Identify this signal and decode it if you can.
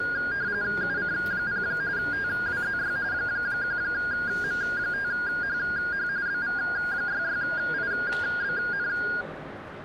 RTTY (45.45 baud, 170 Hz shift), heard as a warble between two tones, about 1550 Hz centre, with radio static and the noise of a crowd indoors. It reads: UC0 TWZY 1M5HH BV66IBN